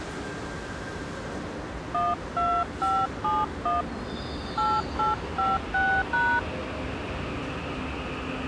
DTMF, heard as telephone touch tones, dialled by hand, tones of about 200 ms, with the noise of a subway station. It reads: 12571 8856#